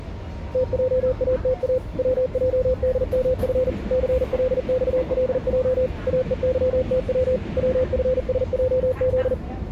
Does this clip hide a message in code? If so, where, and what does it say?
Yes: Morse code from 0.5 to 9.4 s, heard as a keyed tone, machine-sent, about 40 wpm, 510 Hz, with the noise inside a subway train. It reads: TJATA WJDMF CLXLJ AEYTW WFSJZ